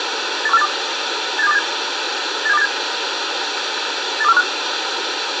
Five-tone selective call (EEA), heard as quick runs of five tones, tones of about 40 ms, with radio hiss and room echo. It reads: 81482 87287 87287 82415